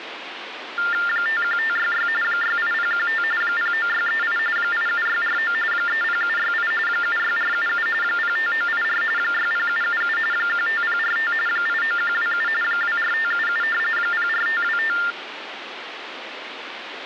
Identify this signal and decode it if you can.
TTY/TDD text telephone tones (45.45 baud Baudot), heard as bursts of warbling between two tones, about 400 Hz shift, 1600 Hz centre, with phone line noise. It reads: 51566 68015 09638 87649 30768 76477 05984 60777 15045 89127 24577 04525